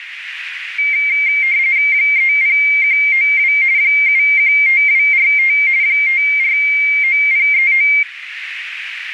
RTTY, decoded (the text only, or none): 30192 715245 549039